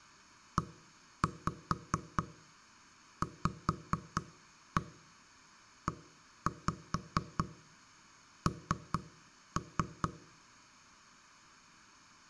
Tap code, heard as knocks on wood, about 4 knocks a second, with room echo. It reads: EVEN